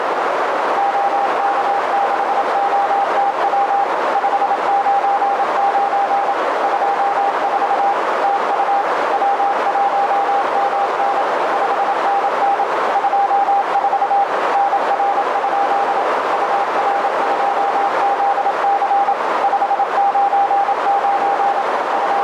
Morse code, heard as a keyed tone, machine-sent, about 27 wpm, 800 Hz, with heavy radio static and a narrow filter. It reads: OK6OTW 599 24 TU W1MN 5NN 24 NR? UR2ZC 599 …